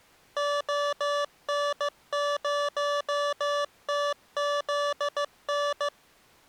Morse code, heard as electronic beeps, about 15 wpm, 580 Hz. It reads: ON0TZN